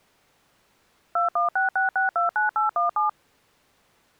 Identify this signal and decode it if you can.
DTMF, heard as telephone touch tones, dialled by machine, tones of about 140 ms. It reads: 2166629817